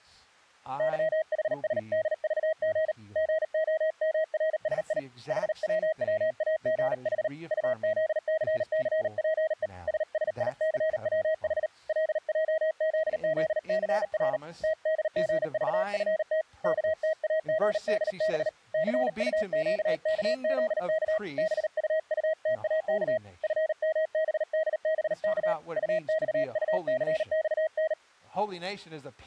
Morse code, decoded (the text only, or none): YHSDVG GOMRSI HWWAGH UZCCPE SSICWH LJZZCR TDGVFT KTAGDB CUQKZK BUUTAK FMBDBK UXUCXN